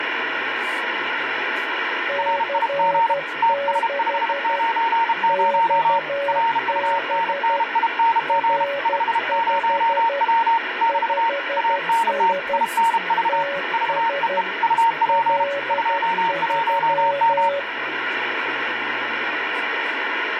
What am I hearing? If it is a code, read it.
Morse code, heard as two keyed tones, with radio static and speech in English. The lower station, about 12 wpm, 560 Hz: C6 XB R5 5S TS L3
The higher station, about 32 wpm, 920 Hz: RIG TS590 RUNNING 50W <BT> ANT INV VEE UP 21M